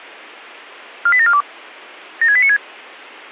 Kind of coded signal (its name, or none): five-tone selective call